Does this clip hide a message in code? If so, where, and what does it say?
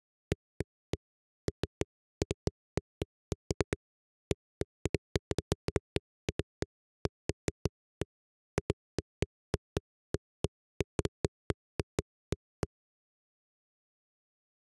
No, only irregular knocks on a wall.